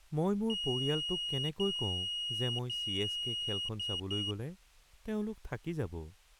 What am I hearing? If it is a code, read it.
Beep code, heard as a piezo beeper, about 2900 Hz, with speech in Assamese. 3 long, 2 short.